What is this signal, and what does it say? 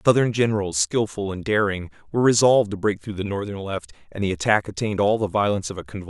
Speech in English. There is no code.